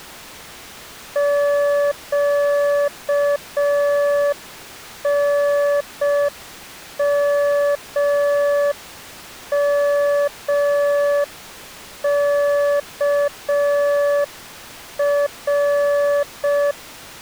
Morse code, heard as a keyed tone, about 5 wpm, 580 Hz. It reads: QNMMKR